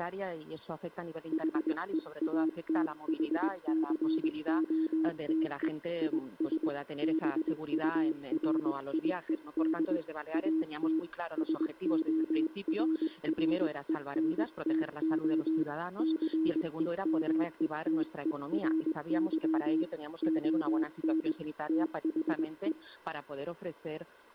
Morse code, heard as a keyed tone, hand-sent with a paddle, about 21 wpm, 320 Hz. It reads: HEATHCOTE IS BURIED AT SORRENTO CEMETERY ON THE